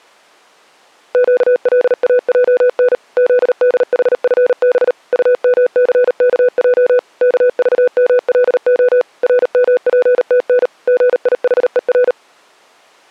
Morse code, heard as a keyed tone, machine-sent, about 38 wpm, 500 Hz. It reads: QLAJN ZDHFB UMCKJ KVMLO RMPTN GIHER